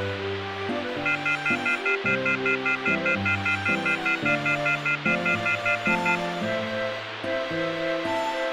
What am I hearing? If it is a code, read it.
Telephone call progress tone (North American plan), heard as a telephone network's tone, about 1400, 2050, 2450, 2600 Hz, 0.1 s on and 0.1 s off, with phone line noise. Off-hook warning tone.